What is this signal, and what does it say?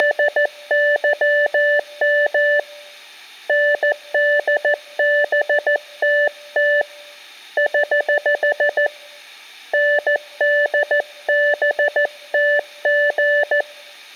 Morse code, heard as a keyed tone, hand-sent with a paddle, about 14 wpm, 580 Hz, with room echo. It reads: … NDBTT <HH> NDBTG